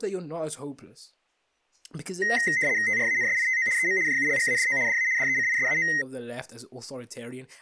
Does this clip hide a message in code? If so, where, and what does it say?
Yes: RTTY (75 baud, 170 Hz shift) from 2.2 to 6.0 s, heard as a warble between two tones, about 1950 Hz centre, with speech in English. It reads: TRANSITO EM JULGADO DA DECISAO